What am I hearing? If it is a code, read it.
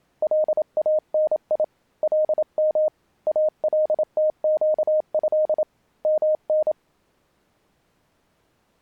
Morse code (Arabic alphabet), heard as a keyed tone, hand-sent with a paddle, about 27 wpm, 620 Hz. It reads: لاني لم التقه من